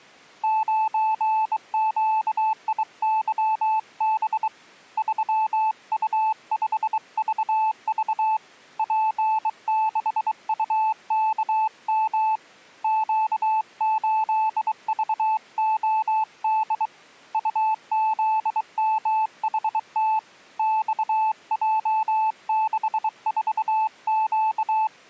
Morse code, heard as a keyed tone, hand-sent with a bug key, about 23 wpm, 870 Hz. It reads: 9QIYB 3U5VV P6UKM Q8VOD UZMHT XJ64Q